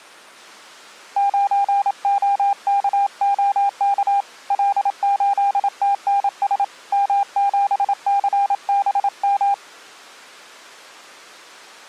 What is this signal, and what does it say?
Morse code, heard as a keyed tone, hand-sent with a paddle, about 27 wpm, 800 Hz. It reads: 9OKOK L8TNS M7CBM